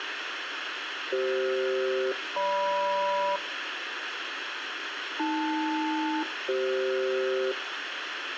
Aircraft SELCAL, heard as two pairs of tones, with radio hiss. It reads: CF-GM AL-CF